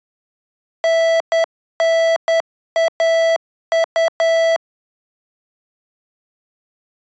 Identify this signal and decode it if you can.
Morse code (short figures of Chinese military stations), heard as electronic beeps, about 10 wpm, 660 Hz. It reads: 9912